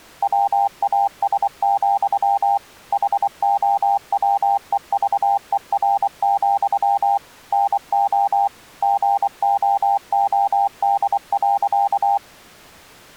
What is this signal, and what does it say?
Morse code, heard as a keyed tone, machine-sent, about 24 wpm, 800 Hz. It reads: WAS, HOWEVER, NO GOOD.